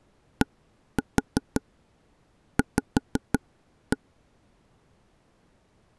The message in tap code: DV

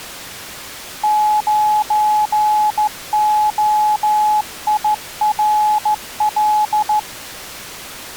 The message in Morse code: 9OIRL

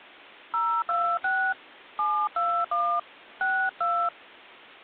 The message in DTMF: 026 721 62

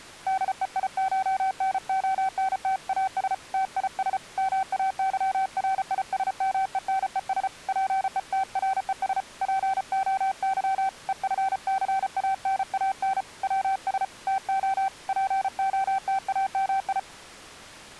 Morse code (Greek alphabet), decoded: ΔΕΙΧΝΟΝΤΑΣ ΤΙΣ ΜΑΥΡΙΣΜΕΝΕΣ ΠΕΤΡΕΣ ΠΟΥ ΕΦΘΑΝΑΝ ΩΣ ΤΟ ΠΟΤΑΜΙ

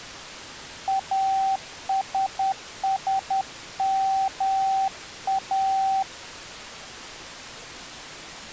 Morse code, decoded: ASSMA

